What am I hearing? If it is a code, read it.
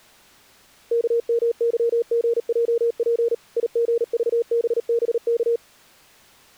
Morse code, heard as a keyed tone, machine-sent, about 38 wpm, 470 Hz. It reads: KMYGJP IGVBBK